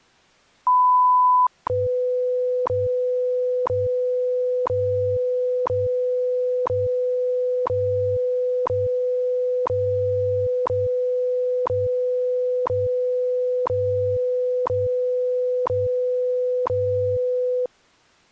Radio time signal (WWV, Colorado), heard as ticks, one a second.